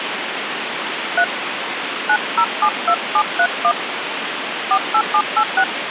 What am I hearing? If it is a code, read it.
DTMF, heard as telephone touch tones, dialled by hand, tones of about 70 ms, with phone line noise. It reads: 3 9072731 48786